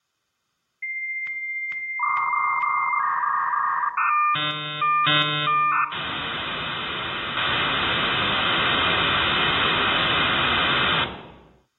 Dial-up modem handshake (V.34 or later), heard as a whistle, warbles, then hiss, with room echo.